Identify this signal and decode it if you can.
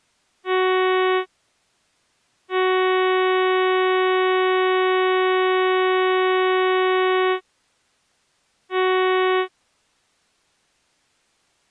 Ship horn signal, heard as a ship's horn, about 370 Hz. 1 short, 1 long, 1 short. At sea: a vessel at anchor warns of its position.